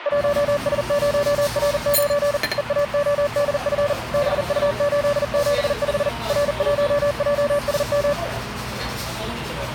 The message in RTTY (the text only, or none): none